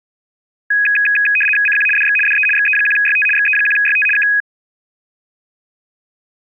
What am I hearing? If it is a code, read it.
RTTY (75 baud, 850 Hz shift), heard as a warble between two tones, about 2100 Hz centre. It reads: CQ DX DE XE1YT XE1YT K